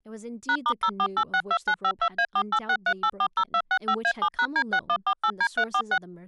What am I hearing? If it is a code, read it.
DTMF, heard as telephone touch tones, dialled by machine, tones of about 70 ms, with speech in English. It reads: #*04862952A4863840265A7#D6148D346